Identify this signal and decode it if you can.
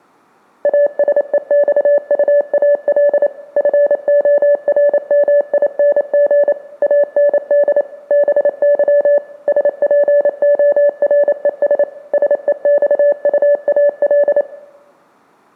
Morse code, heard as a keyed tone, machine-sent, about 28 wpm, 580 Hz. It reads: ASEXUAL FORMING AND BY SPORES SEXUAL